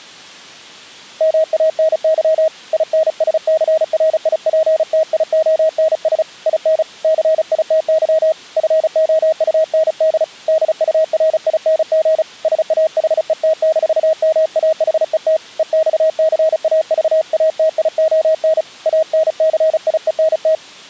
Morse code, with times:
1.2-2.5 MANY
2.7-6.2 INSCRIPTIONS
6.5-6.8 IN
7.0-8.3 CITY
8.6-10.2 FOUND
10.5-12.2 DURING
12.4-15.4 SAHET-MAHET
15.6-18.6 EXCAVATION
18.9-20.5 ANCIENT

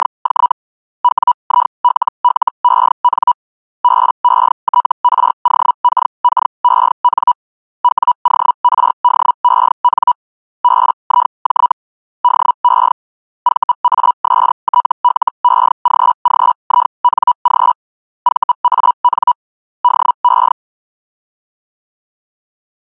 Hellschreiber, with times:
0.0-0.5 …
1.0-3.3 WILLEN
3.8-7.3 BETROKKEN
7.8-10.1 WORDEN
10.6-11.7 BIJ
12.2-12.9 DE
13.4-17.7 VASTLEGGING
18.2-19.3 VAN
19.8-20.5 DE

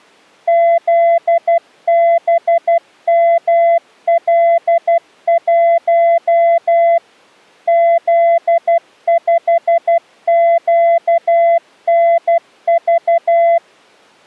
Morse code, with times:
0.5-7.0 ZBML1
7.7-13.6 Z5QNV

